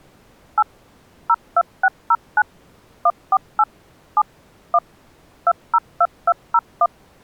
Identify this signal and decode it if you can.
DTMF, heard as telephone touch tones, dialled by machine, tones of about 50 ms. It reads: 8 02609 148 7 1 202201